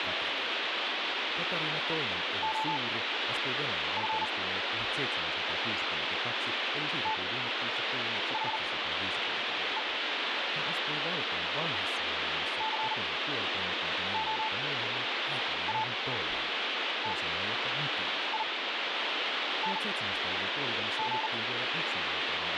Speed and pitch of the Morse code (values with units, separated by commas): 39 wpm, spaced as for 7 wpm, 880 Hz